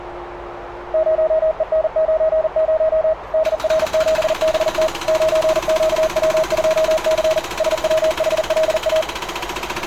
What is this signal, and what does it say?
Morse code, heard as a keyed tone, machine-sent, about 40 wpm, 630 Hz, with radio static, a narrow filter and street noise. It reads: 0EN90 DR7BT 9QW2C SWHLA